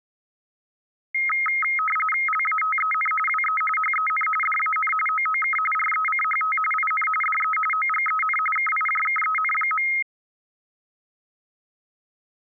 RTTY (45.45 baud, 850 Hz shift), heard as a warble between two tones, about 1700 Hz centre. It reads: LATEN WE HEN DAN OOK RECHT IN DE OGEN KIJKEN.